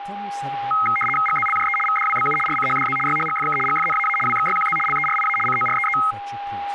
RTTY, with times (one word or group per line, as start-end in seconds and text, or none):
1.3-1.8 GZLJE
1.9-2.4 VDWBU
2.5-3.0 RCHDZ
3.1-3.6 YHGFK
3.7-4.2 GFNAA
4.3-4.8 WXYQZ
4.9-5.4 LERIA
5.5-6.0 COREE